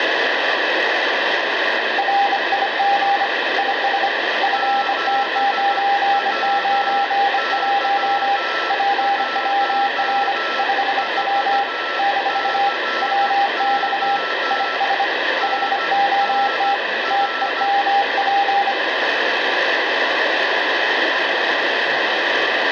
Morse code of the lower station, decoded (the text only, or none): RIG IS FT991 PWR 5W - WX IS HOT TEMP